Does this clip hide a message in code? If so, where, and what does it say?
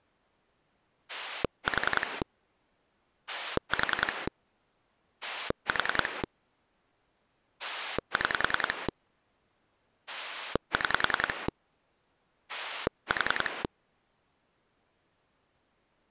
Yes: pulse dialling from 1.1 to 13.7 s, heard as a rotary dial, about 10 pulses a second. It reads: 4 4 4 6 6 4